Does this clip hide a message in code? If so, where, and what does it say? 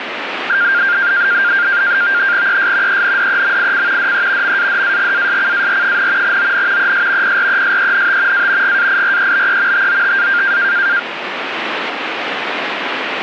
Yes: NAVTEX (SITOR-B), 100 baud, 170 Hz shift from 0.5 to 11.0 s, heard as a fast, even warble, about 1500 Hz centre, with radio static. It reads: ES ENDEMIC DE MADAGASCAR, ON ES PRESENT A GAIREBE TOTA